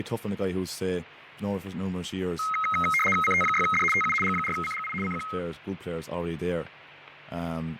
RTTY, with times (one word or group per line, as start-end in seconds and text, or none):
3.2-3.8 CT6D
3.9-4.1 TU
4.2-4.9 G4CGI
5.0-5.2 CQ